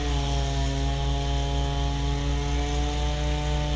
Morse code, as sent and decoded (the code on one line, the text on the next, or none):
none